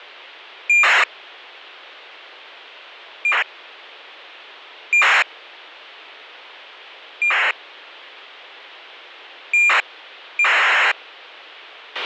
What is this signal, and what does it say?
ACARS aircraft data, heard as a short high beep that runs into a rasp, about 2400 baud, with a squelch burst at the end.